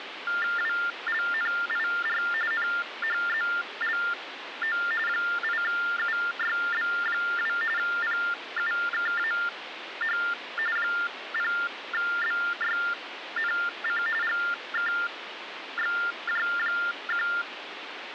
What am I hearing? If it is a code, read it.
TTY/TDD text telephone tones (45.45 baud Baudot), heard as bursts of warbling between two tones, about 400 Hz shift, 1600 Hz centre, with phone line noise. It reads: WLNIR NHZLO 8UYB2 PUKAH 0BYNC GKXJ1